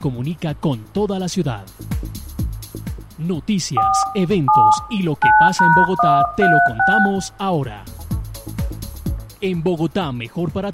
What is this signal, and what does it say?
DTMF, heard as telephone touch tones, dialled by hand, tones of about 260 ms, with room echo. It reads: 4 7 9#136